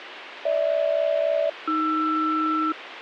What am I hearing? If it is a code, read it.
Aircraft SELCAL, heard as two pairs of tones, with radio hiss. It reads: GH-AR